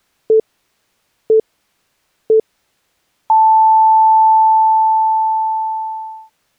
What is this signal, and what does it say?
Radio time signal (three low pips and a long one an octave up, as on NHK), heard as pips.